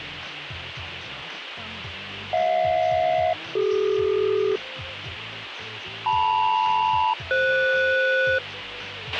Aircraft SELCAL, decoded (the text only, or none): HJ-CD LM-FS